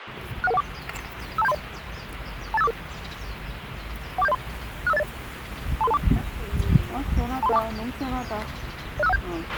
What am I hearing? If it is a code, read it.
Five-tone selective call (EIA), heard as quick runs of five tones, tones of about 30 ms, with radio hiss, a squelch burst at the end and the noise of a park. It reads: 61114 52730 28544 14703 65080 23324 23324 06517